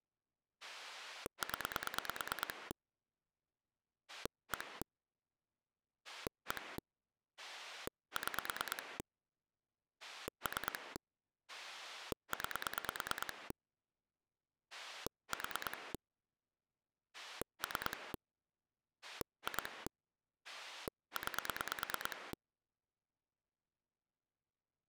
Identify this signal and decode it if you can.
Pulse dialling, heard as a rotary dial, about 9 pulses a second. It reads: 0 1 1 6 3 9 4 3 2 9